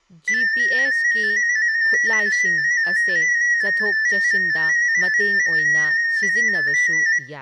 Multi-tone FSK (Olivia or MFSK type), about 250 Hz wide, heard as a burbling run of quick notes, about 15.625 baud, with room echo and speech in Manipuri.